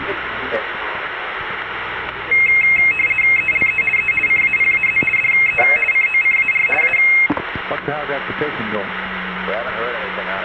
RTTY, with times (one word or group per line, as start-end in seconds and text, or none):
3.4-3.8 ELE
4.0-4.1 E
4.3-5.0 CAPAZ
5.2-5.6 DE
5.9-6.7 COCAR
6.8-7.0 A